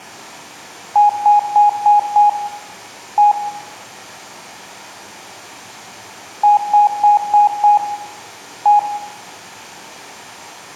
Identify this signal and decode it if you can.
Beep code, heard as beeps, played twice, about 830 Hz, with room echo. 5-1.